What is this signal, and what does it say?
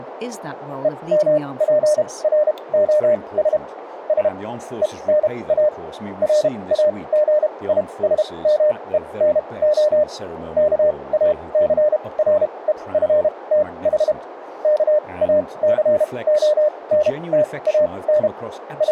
Morse code (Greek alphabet), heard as a keyed tone, machine-sent, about 32 wpm, spaced as for 23 wpm, 600 Hz, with radio static and speech in English. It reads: ΕΜΠΡΟΣ Σ ΕΝΑ ΡΑΓΙΣΜΕΝΟ ΚΑΘΡΕΦΤΗ ΚΑΘΟΝΤΑΝ …